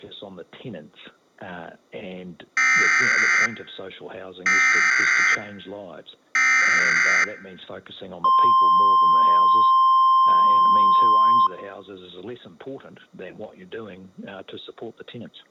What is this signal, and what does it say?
Emergency Alert System (SAME) tones (header bursts, then the 1050 Hz attention tone), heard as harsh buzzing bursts, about 520.83 baud.